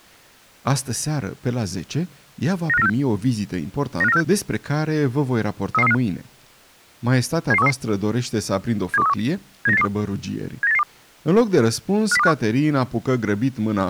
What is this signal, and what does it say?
Five-tone selective call (EEA), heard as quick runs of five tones, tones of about 40 ms, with speech in Romanian. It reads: 95946 95946 33335 77133 72131 79882 79882 50251